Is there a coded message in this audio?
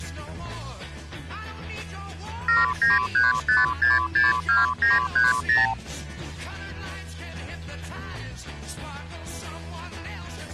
Yes: multi-frequency trunk signalling (R2, with the far end's replies) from 2.5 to 5.7 s, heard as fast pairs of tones, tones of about 170 ms. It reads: 7935662930